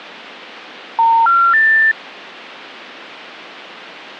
Telephone call progress tone (North American plan), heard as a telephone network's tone, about 910, 1370, 1800 Hz. Special information tone.